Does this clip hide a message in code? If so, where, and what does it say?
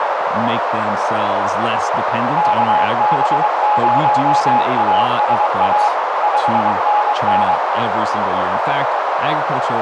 Yes: Morse code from 2.3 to 7.6 s, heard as a keyed tone, machine-sent, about 23 wpm, 840 Hz, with heavy radio static, a narrow filter and speech in English. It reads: KB0ASA 5NN